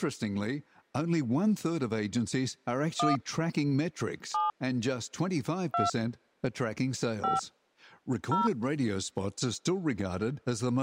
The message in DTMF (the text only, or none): 1 7 2 5 0